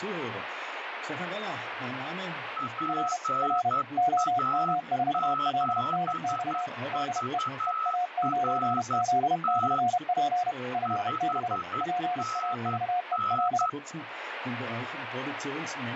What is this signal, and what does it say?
Morse code, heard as two keyed tones, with radio static. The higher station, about 11 wpm, 1300 Hz: PA7VRT 5NN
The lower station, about 31 wpm, 720 Hz: R R OM4LNX DE EA9Z/P FB PAVEL